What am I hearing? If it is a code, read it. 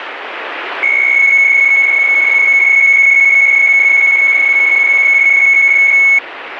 PSK63 (62.5 baud), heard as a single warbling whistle, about 2200 Hz, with radio static.